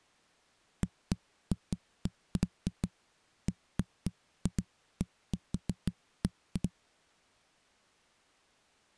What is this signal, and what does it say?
Irregular knocks on a wall. There is no code.